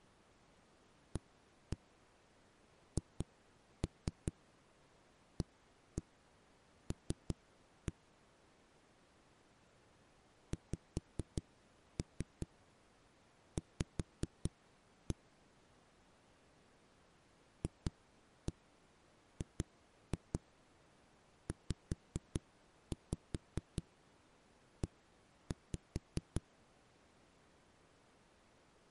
Tap code, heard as knocks on a wall, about 5 knocks a second. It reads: AHAL XV FGZE